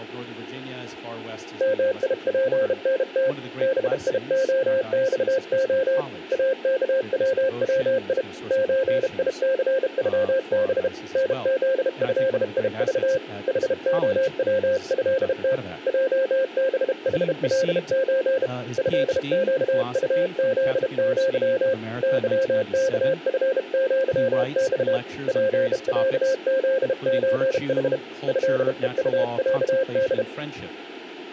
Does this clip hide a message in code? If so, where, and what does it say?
Yes: Morse code (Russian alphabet) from 1.5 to 30.3 s, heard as a keyed tone, hand-sent with a bug key, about 32 wpm, 530 Hz. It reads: МИПНТ БИОЬО АКВВИ ЧИЦЮБ НЗЭИЖ ХОВЭТ ЙБХЛЧ ЭЩУЗЪ ЫКФЪЬ ПЯЗЧХ ЭЕУЯД